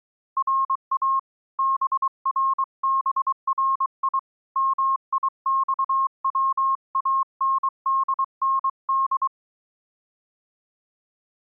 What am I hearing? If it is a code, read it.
Morse code (Persian alphabet), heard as a keyed tone, hand-sent with a paddle, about 23 wpm, 1080 Hz. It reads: را بربری میخواندند